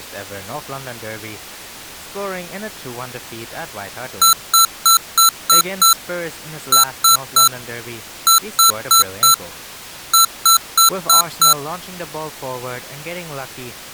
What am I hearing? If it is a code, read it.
Beep code, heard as beeps from a small speaker, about 1340 Hz, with speech in English. 6-3-4-5.